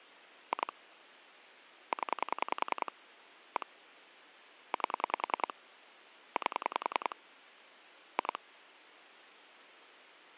Pulse dialling, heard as clicks on a phone line, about 10 pulses a second. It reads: 2 0 1 8 8 2